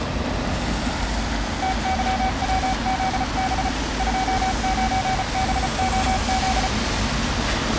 Morse code, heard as a keyed tone, hand-sent with a paddle, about 34 wpm, 760 Hz, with street noise. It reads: TYWZB 29BOZ